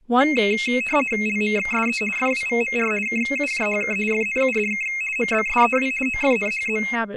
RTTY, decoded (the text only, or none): LMXSE FWVMR KUJHK FNUDK MBSEW OFNHZ